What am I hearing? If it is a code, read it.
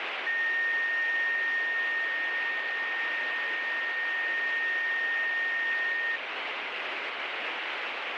A steady tone, with radio static. There is no code.